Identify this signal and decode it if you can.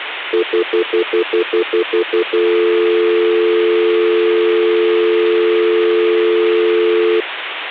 Telephone call progress tone (North American plan), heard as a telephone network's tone, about 350, 440 Hz, 0.1 s on and 0.1 s off. Stutter dial tone.